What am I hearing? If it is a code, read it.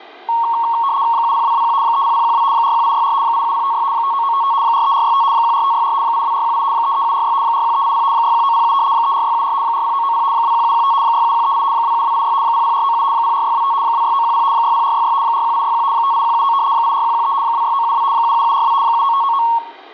RTTY (75 baud, 170 Hz shift), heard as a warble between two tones, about 1010 Hz centre, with room echo. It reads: 70221 30012 41864 87056 59955 43465 14564 82418 33746 41380 61907 34674 40990 21715 67138 27286 00497 04625 26910 60466 41861 58179 84113 26972 77742 79599